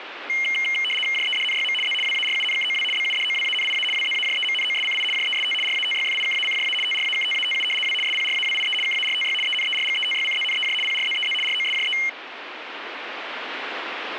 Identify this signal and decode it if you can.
RTTY (75 baud, 850 Hz shift), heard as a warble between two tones, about 2550 Hz centre, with radio static. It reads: JEDNYM Z WARUNKOW BUDOWANIA WZAJEMNOSCI JEST RATYFIKACJA TRAKTATU W SPRAWIE KARTY ENERGETYCZNEJ PRZEZ ROSJE